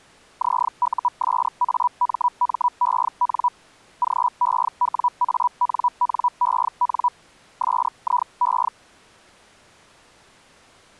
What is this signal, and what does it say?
Hellschreiber (Feld-Hell, 122.5 baud), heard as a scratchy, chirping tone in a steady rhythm, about 980 Hz. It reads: ZUSAMMEN GEWANNEN SIE